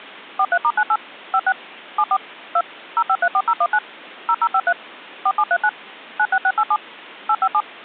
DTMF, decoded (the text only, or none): 43*98 56 74 2 0534019 0053 4739 96687 857